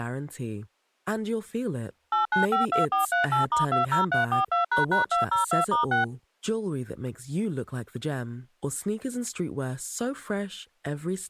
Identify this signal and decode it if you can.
DTMF, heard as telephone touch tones, dialled by machine, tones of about 130 ms, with speech in English. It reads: 8952438*20342##202*6